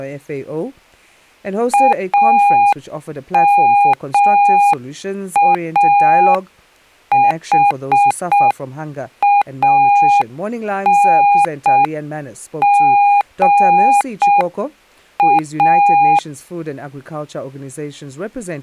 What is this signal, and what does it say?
Morse code, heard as a keyed tone, hand-sent with a paddle, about 6 wpm, 810 Hz, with speech in English. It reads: AMAHANGA